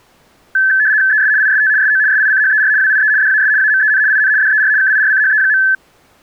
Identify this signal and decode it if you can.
RTTY (75 baud, 170 Hz shift), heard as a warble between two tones, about 1650 Hz centre. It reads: ES IST SO SICHER WIE DAS AMEN IN DER KIRCHE.